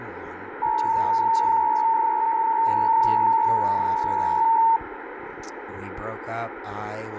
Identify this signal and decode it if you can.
PSK63 (62.5 baud), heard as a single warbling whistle, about 910 Hz, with radio static.